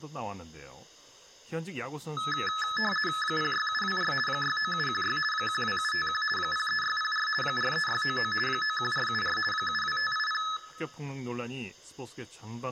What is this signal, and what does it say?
RTTY (50 baud, 450 Hz shift), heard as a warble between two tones, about 1500 Hz centre, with speech in Korean. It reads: 06724 69716 12751 03604 43699 91474 72580